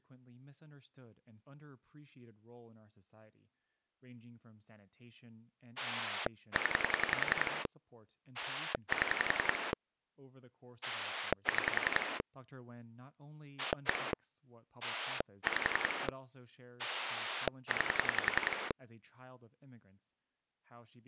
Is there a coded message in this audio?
Yes: pulse dialling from 5.8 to 18.7 s, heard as a rotary dial, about 10 pulses a second, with speech in English. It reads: 0 7 6 1 5 9